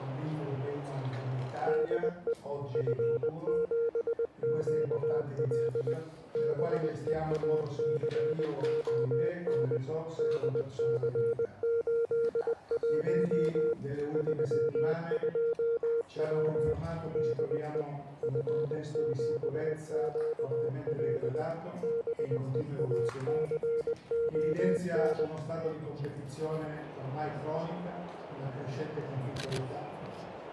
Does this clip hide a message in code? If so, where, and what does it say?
Yes: Morse code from 1.6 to 25.3 s, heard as a keyed tone, machine-sent, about 20 wpm, 460 Hz. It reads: DE F7QL BEACON DC81 32W DE F7QL BEACON